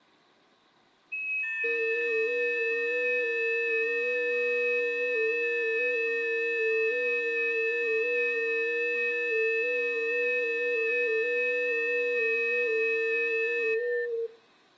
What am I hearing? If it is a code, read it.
FT8 (several signals at once), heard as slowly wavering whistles, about 6.25 baud, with room echo.